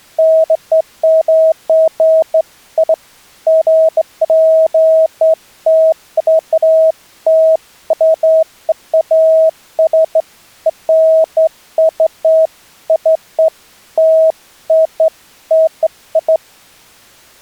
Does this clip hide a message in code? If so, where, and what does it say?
No, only beeps of irregular length.